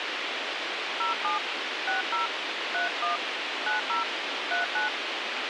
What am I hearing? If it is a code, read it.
DTMF, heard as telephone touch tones, dialled by hand, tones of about 140 ms, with radio hiss. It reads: 07 60 31 90 39